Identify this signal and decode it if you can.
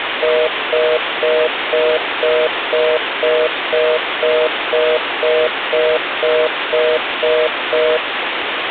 Telephone call progress tone (North American plan), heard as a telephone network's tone, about 480, 620 Hz, 0.25 s on and 0.25 s off, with phone line noise. Congestion tone.